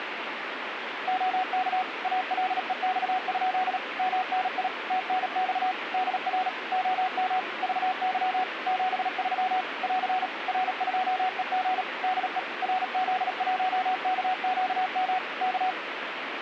Morse code, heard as a keyed tone, machine-sent, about 37 wpm, 740 Hz, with radio static. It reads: OK ALEX? MNI TNX DR OM VY 73 <AR> R2EG DE RZ1KQM K